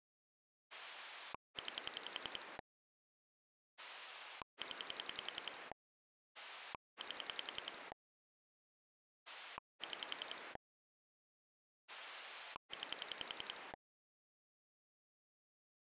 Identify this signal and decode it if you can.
Pulse dialling, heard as a rotary dial, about 10 pulses a second. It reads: 9 0 8 6 9